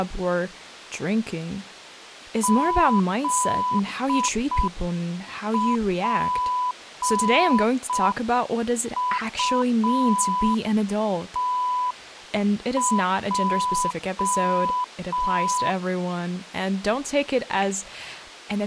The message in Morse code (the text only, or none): ZPUTJ